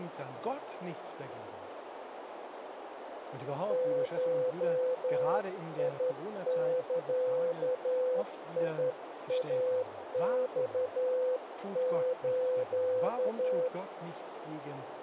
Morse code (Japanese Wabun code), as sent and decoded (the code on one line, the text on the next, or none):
---- .. -.-.- .. .- -..- ---.-
ゴザイマス